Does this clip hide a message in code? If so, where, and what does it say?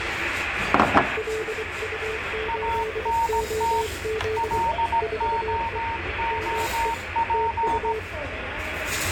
Yes: Morse code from 1.1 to 8.1 s, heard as two keyed tones, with radio static and the noise of a restaurant. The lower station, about 24 wpm, 440 Hz: LU8OZ 4E ME TU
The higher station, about 17 wpm, 920 Hz: ANT LOOP